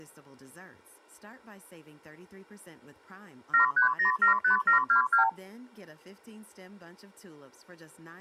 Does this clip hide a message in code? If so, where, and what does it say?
Yes: multi-frequency trunk signalling (R2, with the far end's replies) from 3.5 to 5.3 s, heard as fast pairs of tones, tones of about 110 ms, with speech in English. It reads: 73075722